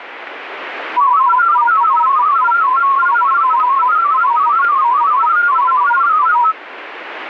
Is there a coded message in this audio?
Yes: multi-tone FSK (Olivia or MFSK type), about 500 Hz wide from 1.0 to 6.6 s, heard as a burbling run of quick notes, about 31.25 baud.